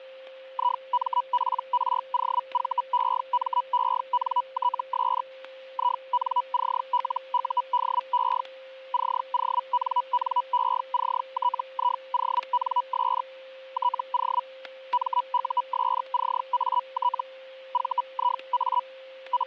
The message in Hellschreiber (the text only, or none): IMPROVEMENTS INCLUDE CONNECTIONS TO MUSCAT VIA …